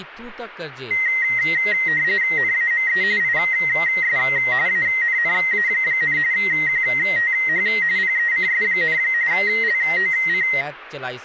RTTY (45.45 baud, 170 Hz shift), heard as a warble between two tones, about 2000 Hz centre, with speech in Dogri. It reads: NAME IS ANNA, QTH PECS, LOC